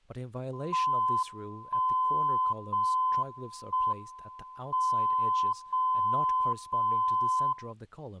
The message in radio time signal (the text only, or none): 1 0 1 M 0 0 0